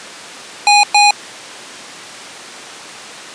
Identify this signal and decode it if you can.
Beep code, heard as beeps from a small speaker, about 820 Hz. 2 short. In AMI BIOS tables: memory parity error; in IBM BIOS tables: self-test error shown on screen; in Dell tables: no memory detected.